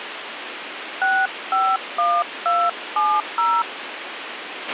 DTMF, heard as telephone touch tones, dialled by hand, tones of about 240 ms, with radio hiss and a squelch burst at the end. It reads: 651270